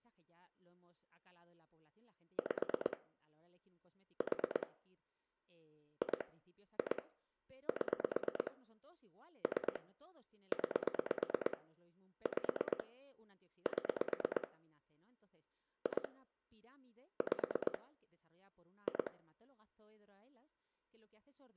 Pulse dialling, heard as clicks on a phone line, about 8 pulses a second, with room echo and speech in Spanish. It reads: 5 4 2 2 7 3 9 5 7 2 5 2